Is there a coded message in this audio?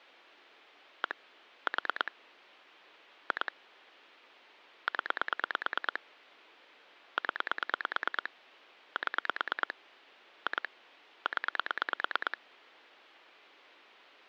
Yes: pulse dialling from 1.0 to 12.3 s, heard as clicks on a phone line, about 9 pulses a second. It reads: 1 4 2 0 0 7 2 0